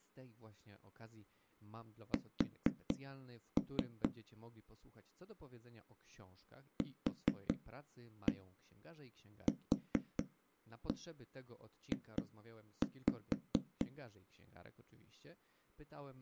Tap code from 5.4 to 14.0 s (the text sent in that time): QQJ